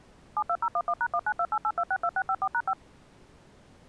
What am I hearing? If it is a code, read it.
DTMF, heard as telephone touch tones, dialled by machine, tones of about 60 ms. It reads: 72011#19288262654#5